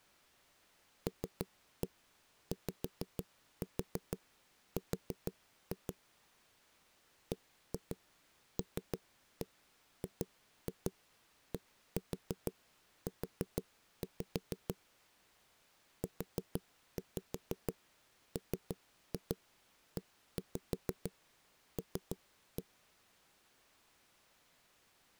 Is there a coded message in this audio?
Yes: tap code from 1.1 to 22.6 s, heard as knocks on a wall, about 6 knocks a second. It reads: LYR BLGDU UMEL